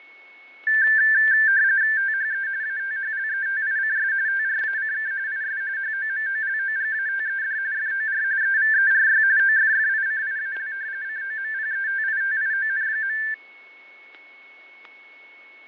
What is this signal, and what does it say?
RTTY (45.45 baud, 170 Hz shift), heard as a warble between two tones, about 1650 Hz centre, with fading, static crashes and a steady whistle near 2200 Hz. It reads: THE ATHLETICS TRACK IS HOMOLOGATED FOR EVERY OFFICIAL COMPETITION.